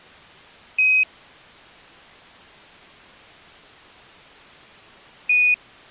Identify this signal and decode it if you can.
Quindar tones, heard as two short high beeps.